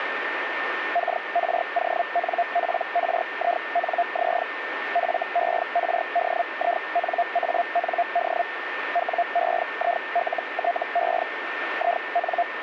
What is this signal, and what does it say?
Hellschreiber (Feld-Hell, 122.5 baud), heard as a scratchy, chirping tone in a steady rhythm, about 700 Hz, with radio static and a steady whistle near 1810 Hz. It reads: KRONPRINZ FERDINAND WEILTE IN